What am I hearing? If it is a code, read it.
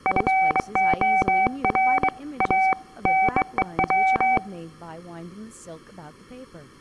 Morse code, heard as a keyed tone, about 23 wpm, 760 Hz, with speech in English. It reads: FOR A NEW